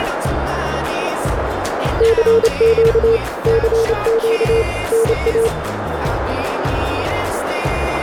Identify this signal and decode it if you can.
Morse code, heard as a keyed tone, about 28 wpm, 450 Hz, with heavy radio static and a narrow filter. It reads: CQ CQ NA